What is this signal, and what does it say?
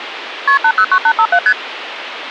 Multi-frequency trunk signalling (R1, as on North American trunks), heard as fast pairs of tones, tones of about 70 ms, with phone line noise. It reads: KP 809857 ST